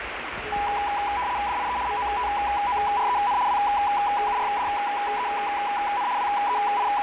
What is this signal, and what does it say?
RTTY (75 baud, 170 Hz shift), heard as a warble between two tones, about 900 Hz centre, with radio static and the noise inside a lift. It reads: DIE MOTOREN WURDEN …